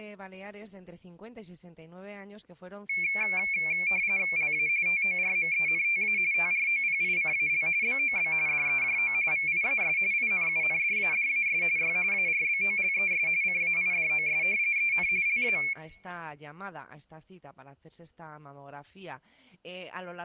RTTY (45.45 baud, 170 Hz shift), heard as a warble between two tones, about 2300 Hz centre. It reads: LA TORMENTA TROPICAL BOB DEJO VIAS INUNDADAS Y ARBOLES CAIDOS EN LA